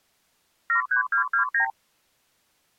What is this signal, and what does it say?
Multi-frequency trunk signalling (R2, with the far end's replies), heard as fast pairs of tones, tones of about 110 ms. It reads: 73229